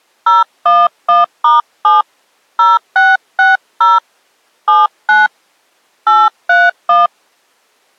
DTMF, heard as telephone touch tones, dialled by hand, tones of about 190 ms. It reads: 011*7 0660 79 831